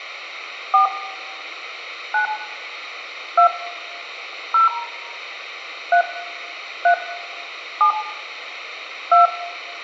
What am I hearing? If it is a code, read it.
DTMF, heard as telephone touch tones, dialled by hand, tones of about 110 ms, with room echo. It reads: 4 9 2 0 3 3 7 2